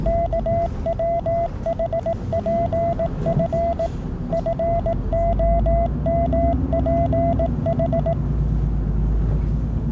Morse code, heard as a keyed tone, machine-sent, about 18 wpm, 680 Hz, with the noise inside a bus. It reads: KWHPF FOMPH